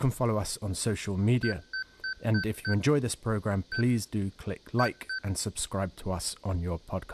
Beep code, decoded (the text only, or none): 5-1-2